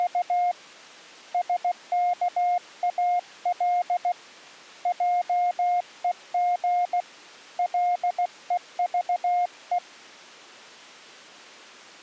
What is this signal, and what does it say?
Morse code, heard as a keyed tone, hand-sent with a paddle, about 16 wpm, 710 Hz. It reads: … SKAL JEG LEVE